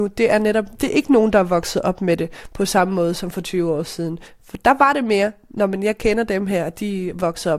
Speech in Danish. There is no code.